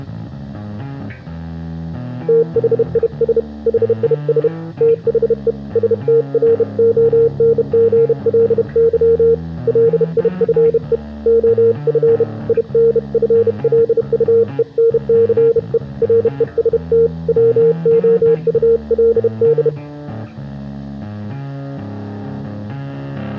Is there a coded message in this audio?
Yes: Morse code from 2.2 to 19.7 s, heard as a keyed tone, hand-sent with a bug key, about 31 wpm, 460 Hz. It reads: THIS HIS THE STRONGLY LIFE OF INFLUENCE REST WOULD